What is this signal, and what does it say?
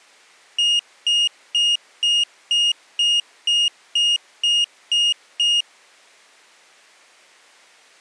Beep code, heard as a piezo beeper, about 2850 Hz. 11 short. In AMI BIOS tables: cache memory error.